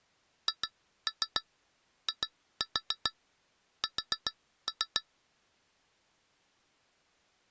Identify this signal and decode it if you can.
Tap code, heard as taps on glass, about 7 knocks a second. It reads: HIS